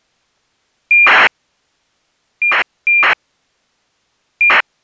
ACARS aircraft data, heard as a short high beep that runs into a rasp, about 2400 baud.